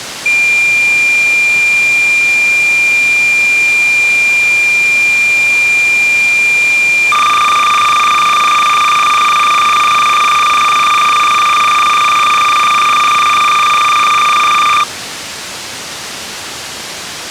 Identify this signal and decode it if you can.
Cassette data (Kansas City type), 300 baud, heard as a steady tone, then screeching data, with tape hiss.